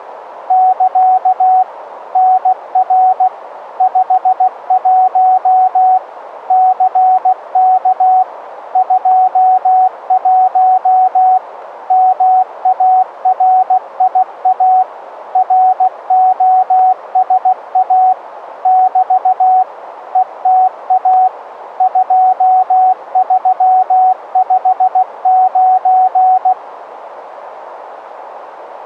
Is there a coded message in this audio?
Yes: Morse code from 0.4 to 26.6 s, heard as a keyed tone, machine-sent, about 16 wpm, 750 Hz, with radio static. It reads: <KA> NR 51 CK 21 MARIA ROSA <BT> ETA 2359